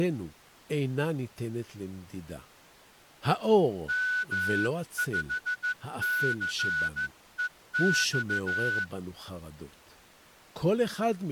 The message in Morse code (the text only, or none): M5CEX